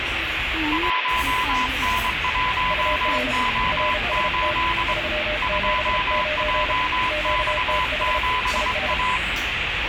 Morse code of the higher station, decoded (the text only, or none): 1N1O8 2JX7A